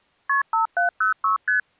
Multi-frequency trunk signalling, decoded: KP 5706 ST

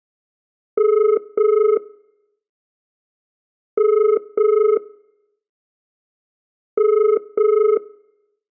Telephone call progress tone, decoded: ringback tone

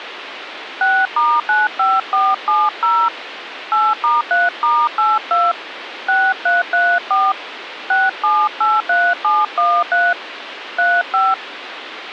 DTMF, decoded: 6*95470 8*3*82 6334 6783713 35

